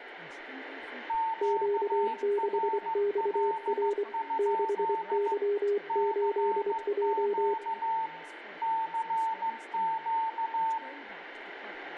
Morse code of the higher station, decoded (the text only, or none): QRL? CQ CQ